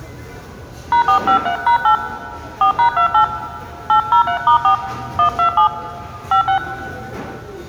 DTMF, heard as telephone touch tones, dialled by hand, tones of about 100 ms, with room echo and the noise of a restaurant. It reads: #453#8 4#28 803*4 127 56